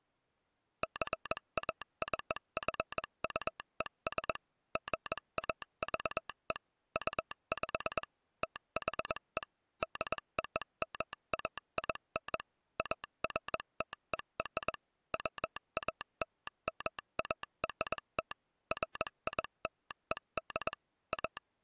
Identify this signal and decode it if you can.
Morse code (American railroad code), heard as a telegraph sounder, machine-sent. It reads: JACQUES GAVE UP THE DOMAIN AFTER WALMART FILED A